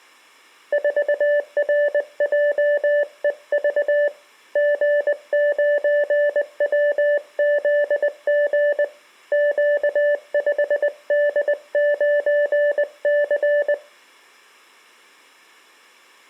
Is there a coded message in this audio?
Yes: Morse code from 0.7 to 13.8 s, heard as a keyed tone, hand-sent with a paddle, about 20 wpm, 580 Hz. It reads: 4RJEV G9WZG Q5D9C